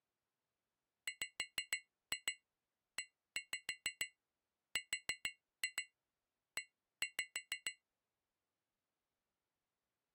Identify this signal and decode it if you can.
Tap code, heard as taps on glass, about 6 knocks a second. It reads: WERE